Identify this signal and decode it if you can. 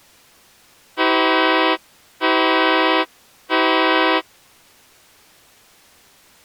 Train horn signal, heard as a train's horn. 3 short. On North American railways: when stopped, the train will back up.